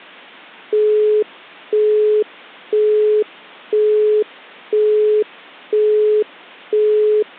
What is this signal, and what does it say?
Telephone call progress tone (single-tone plan, as in Europe, Japan and elsewhere), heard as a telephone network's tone, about 420 Hz, 0.5 s on and 0.5 s off. Busy tone.